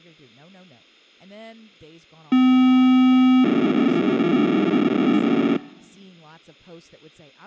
POCSAG pager data (512 baud), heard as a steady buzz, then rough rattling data, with speech in English.